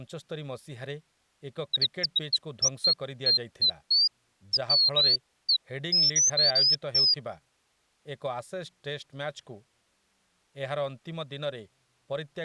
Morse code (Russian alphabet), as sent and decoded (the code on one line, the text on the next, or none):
none